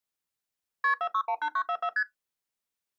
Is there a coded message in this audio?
Yes: multi-frequency trunk signalling (R1, as on North American trunks) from 0.8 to 2.0 s, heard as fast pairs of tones, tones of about 70 ms. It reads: KP 4618944 ST